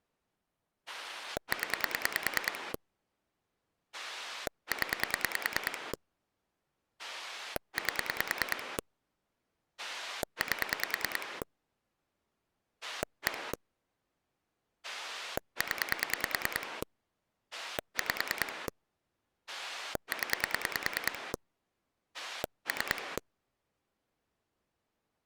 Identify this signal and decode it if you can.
Pulse dialling, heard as a rotary dial, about 9 pulses a second. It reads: 0 0 8 8 1 0 5 0 3